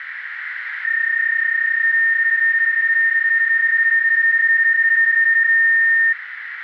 PSK31 (31.25 baud), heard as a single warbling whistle, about 1800 Hz, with radio static and a narrow filter.